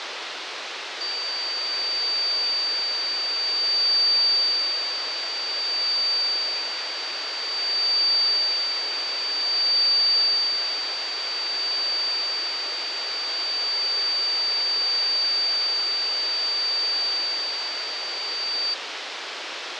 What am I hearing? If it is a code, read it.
A steady tone, with radio static and fading. There is no code.